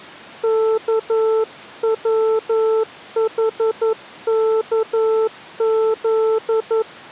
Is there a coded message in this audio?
Yes: Morse code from 0.4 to 6.9 s, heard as a keyed tone, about 11 wpm, 440 Hz. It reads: KWHKZ